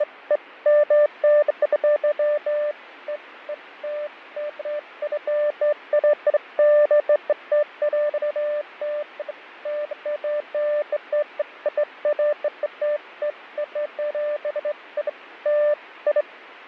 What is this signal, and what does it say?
Beeps of irregular length, with radio static and fading. There is no code.